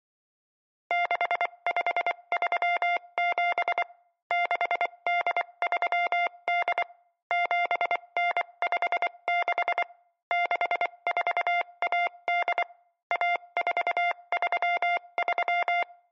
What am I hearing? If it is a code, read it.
Morse code (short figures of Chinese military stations), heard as a keyed tone, machine-sent, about 24 wpm, spaced as for 21 wpm, 700 Hz. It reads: 6537 6838 7956 6418 1433